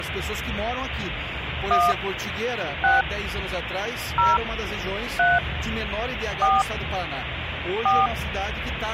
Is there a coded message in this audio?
Yes: DTMF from 1.7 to 8.1 s, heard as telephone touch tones, dialled by hand, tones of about 180 ms, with phone line noise. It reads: 1 6 0 3 4 4